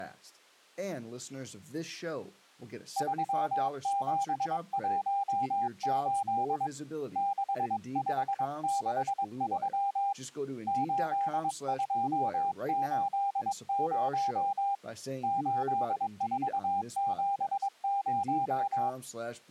Morse code, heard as a keyed tone, hand-sent with a paddle, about 22 wpm, 800 Hz, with speech in English. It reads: 3718 6563 8280 8470